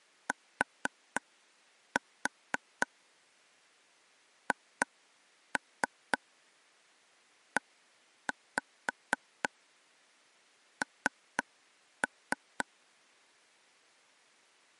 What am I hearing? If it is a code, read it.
Tap code, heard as taps on a table, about 4 knocks a second. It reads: THEN